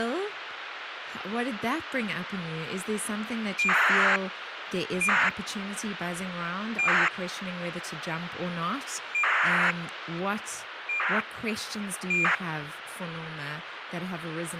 ACARS aircraft data, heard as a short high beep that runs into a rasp, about 2400 baud, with radio hiss and speech in English.